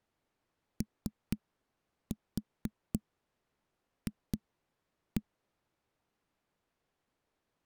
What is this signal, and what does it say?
Tap code, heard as knocks on a wall, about 4 knocks a second. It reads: OF